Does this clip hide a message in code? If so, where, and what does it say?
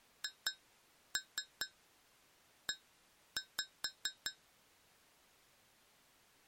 Yes: tap code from 0.2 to 4.4 s, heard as taps on glass, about 4 knocks a second. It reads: HE